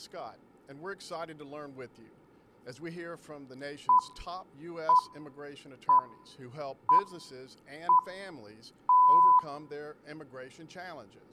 Radio time signal (six pips, as the Greenwich Time Signal), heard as pips, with room echo.